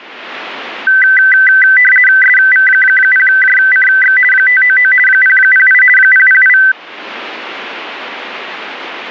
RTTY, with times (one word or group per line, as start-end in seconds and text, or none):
2.2-4.2 SV0JCX
4.3-4.9 599
5.1-5.8 008
6.0-6.6 008